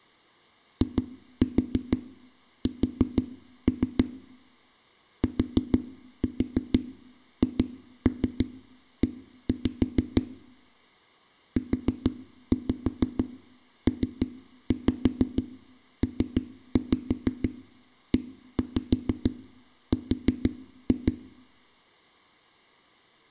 Tap code, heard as knocks on a wall, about 6 knocks a second, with room echo. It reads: IS THE UPPER